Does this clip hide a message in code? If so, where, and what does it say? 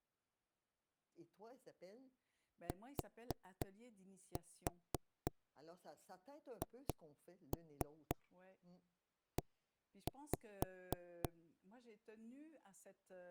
Yes: tap code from 2.7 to 11.3 s, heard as knocks on wood, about 3 knocks a second, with speech in French. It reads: THE